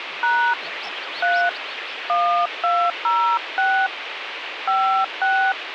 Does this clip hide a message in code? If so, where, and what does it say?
Yes: DTMF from 0.2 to 5.5 s, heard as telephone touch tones, dialled by hand, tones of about 290 ms, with phone line noise. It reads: # 3 1206 56